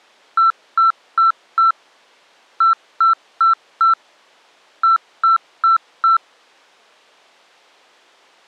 Beep code, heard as beeps, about 1340 Hz. 4-4-4.